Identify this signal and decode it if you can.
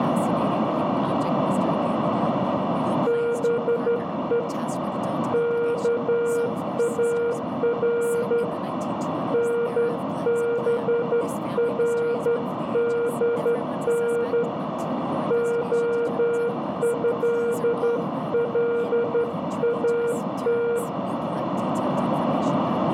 Morse code (Persian alphabet), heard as a keyed tone, hand-sent with a straight key, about 12 wpm, 470 Hz, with radio static, a narrow filter, room echo and speech in English. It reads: به کار نبردن عضلات